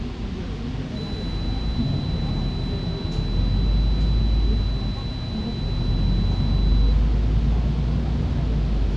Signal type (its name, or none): none